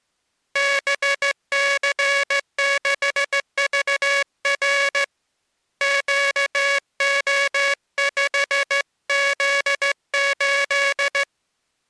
Morse code, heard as a buzzer, hand-sent with a straight key, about 14 wpm. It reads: BC6VR QO5Z8